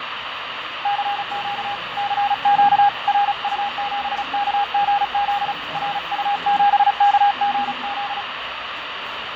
Morse code, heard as a keyed tone, hand-sent with a paddle, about 35 wpm, 810 Hz, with radio static, fading and the noise of a crowd indoors. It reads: CQ CQ RU7KGZ RU7KGZ